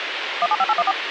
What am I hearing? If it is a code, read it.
DTMF, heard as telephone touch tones, dialled by machine, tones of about 40 ms, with radio hiss and a squelch burst at the end. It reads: 175814